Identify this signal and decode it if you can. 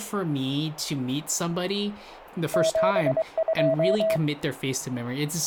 Morse code, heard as a keyed tone, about 23 wpm, 650 Hz, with radio static and speech in English. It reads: 72